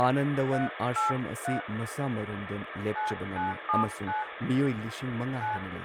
DTMF, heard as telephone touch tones, dialled by hand, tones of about 150 ms, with phone line noise and speech in Manipuri. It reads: 383 9979 9